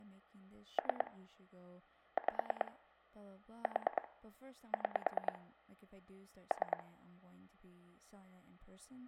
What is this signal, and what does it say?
Pulse dialling, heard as clicks on a phone line, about 9 pulses a second, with speech in English. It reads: 3 5 4 6 3